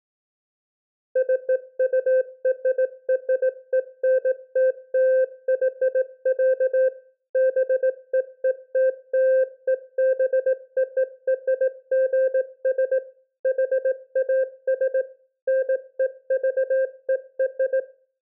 Morse code (American railroad code), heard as a keyed tone, machine-sent, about 520 Hz, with room echo. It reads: CURRENTLY, BEETLEBORGS HAS NEVER